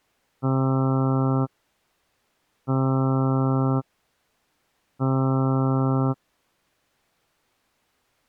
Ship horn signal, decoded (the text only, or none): 3 short